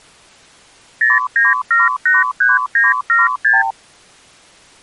Multi-frequency trunk signalling (R2, with the far end's replies), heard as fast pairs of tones, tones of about 170 ms. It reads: 09783976